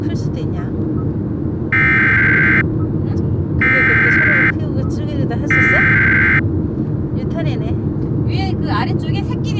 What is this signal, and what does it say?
Emergency Alert System (SAME) tones (header bursts), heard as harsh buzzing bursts, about 520.83 baud, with the noise inside a car.